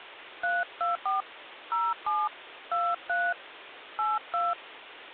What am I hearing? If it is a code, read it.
DTMF, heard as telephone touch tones, dialled by hand, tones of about 180 ms, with phone line noise. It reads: 324 07 23 82